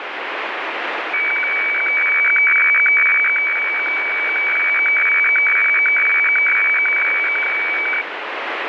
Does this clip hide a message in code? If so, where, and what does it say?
Yes: weather fax (radiofax), 120 lines a minute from 1.1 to 8.0 s, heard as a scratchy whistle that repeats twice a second, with radio static.